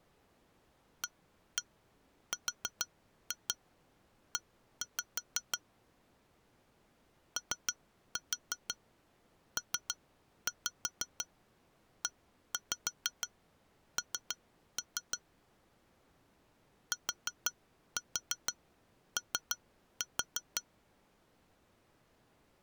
Tap code, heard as taps on glass, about 6 knocks a second. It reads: ARE OPEN TO